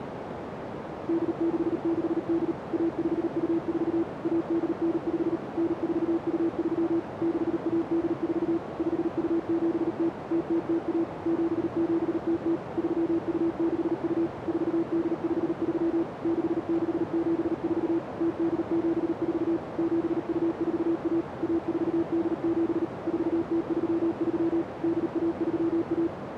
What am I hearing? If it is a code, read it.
Morse code (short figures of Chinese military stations), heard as a keyed tone, machine-sent, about 38 wpm, 330 Hz, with radio static and a narrow filter. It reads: 8668 1524 1895 9423 6184 5270 0001 7700 3262 4853 6674 0874 7241 1487 4033 8131